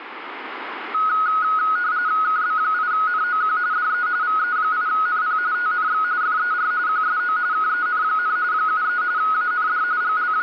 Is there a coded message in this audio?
Yes: RTTY (45.45 baud, 170 Hz shift) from 0.9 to 10.4 s, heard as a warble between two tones, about 1360 Hz centre, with radio static. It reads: KB8NOQ DE VE8NP TNX FER QSO KEN, 73 AND …